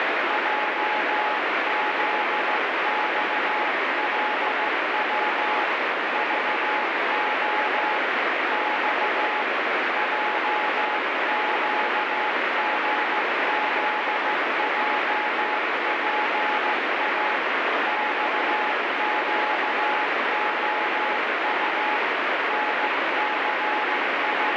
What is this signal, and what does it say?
Morse code, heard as a keyed tone, hand-sent with a straight key, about 15 wpm, 850 Hz, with heavy radio static. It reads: JZXLW VO X JQGZJPA XQOU …